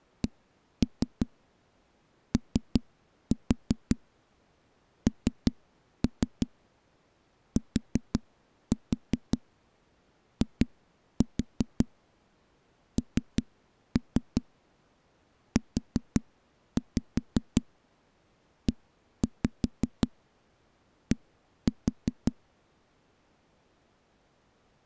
Tap code, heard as knocks on a wall, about 5 knocks a second. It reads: CONTINUED